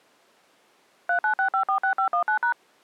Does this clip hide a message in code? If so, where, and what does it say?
Yes: DTMF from 1.1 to 2.5 s, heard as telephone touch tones, dialled by machine, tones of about 100 ms. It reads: 396546519#